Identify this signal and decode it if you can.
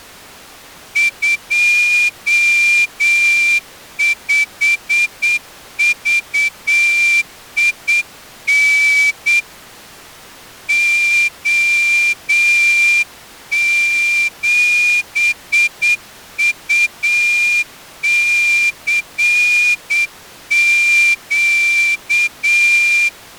Morse code, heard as a whistle, hand-sent with a straight key, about 8 wpm. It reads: 25VIN O7UCQ